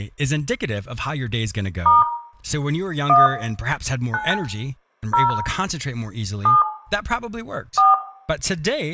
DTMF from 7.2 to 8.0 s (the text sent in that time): 4